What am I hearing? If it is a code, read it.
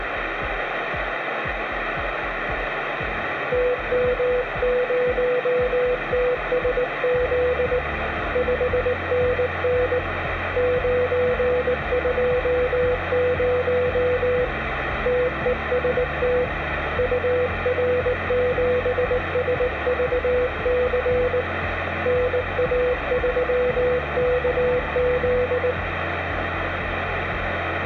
Morse code, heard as a keyed tone, hand-sent with a paddle, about 19 wpm, 500 Hz, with radio static. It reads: TM0TSZ 5NN 920 TEST UR7SVC NA3KZ